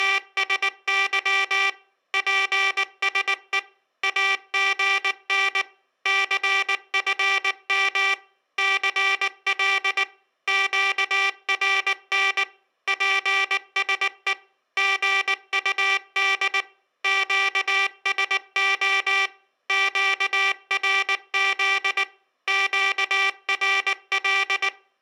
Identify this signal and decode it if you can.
Morse code, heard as a buzzer, machine-sent, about 19 wpm. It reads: … PSE AGN CFM CL QRN PSE GUD QSO QRZ QRL